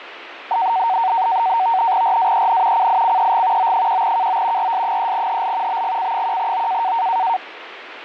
NAVTEX (SITOR-B), 100 baud, 170 Hz shift, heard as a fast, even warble, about 840 Hz centre, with radio static. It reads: RAEN CICEG O1KO RS3HL BGC1O